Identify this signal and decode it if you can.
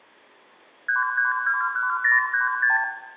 Multi-frequency trunk signalling (R2, with the far end's replies), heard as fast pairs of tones, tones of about 140 ms, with room echo. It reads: 3321036